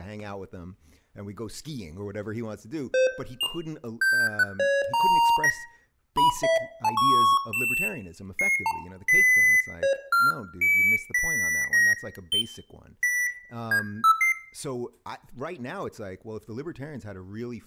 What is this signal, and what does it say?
Electronic bleeps of random pitch and length, with room echo and speech in English. There is no code.